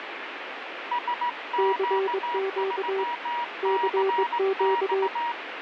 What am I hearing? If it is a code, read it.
Morse code, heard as two keyed tones, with radio static. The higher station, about 18 wpm, 960 Hz: SQ3CX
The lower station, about 21 wpm, 390 Hz: CQ CQ